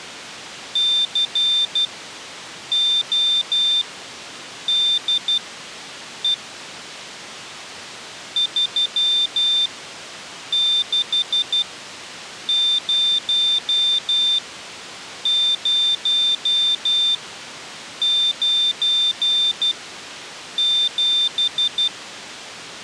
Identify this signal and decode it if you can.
Morse code, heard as a high beeper, machine-sent, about 12 wpm, spaced as for 7 wpm, 3600 Hz. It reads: CODE 360097